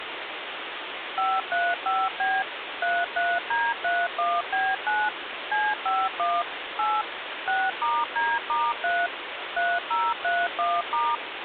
DTMF, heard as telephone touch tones, dialled by machine, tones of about 220 ms, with phone line noise. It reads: 535B 33D31B9 C51 8 6*D*3 3031*